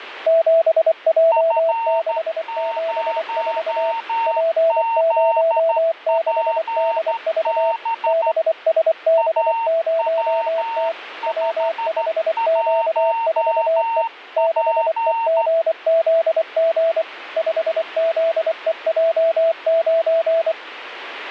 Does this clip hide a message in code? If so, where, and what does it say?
Yes: Morse code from 0.2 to 20.6 s, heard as two keyed tones, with radio static. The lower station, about 24 wpm, 660 Hz: 7J674 P06DV BSB0T W5Q4E 6EGZG 5ZEJ9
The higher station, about 13 wpm, 910 Hz: F0ZPB AW51P